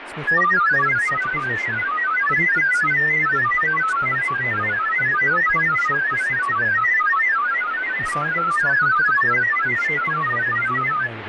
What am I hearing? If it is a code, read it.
Multi-tone FSK (Olivia or MFSK type), about 1000 Hz wide, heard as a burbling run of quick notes, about 31.25 baud, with radio static and speech in English.